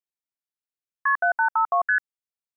Multi-frequency trunk signalling (R1, as on North American trunks), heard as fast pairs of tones, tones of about 100 ms. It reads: KP 7852 ST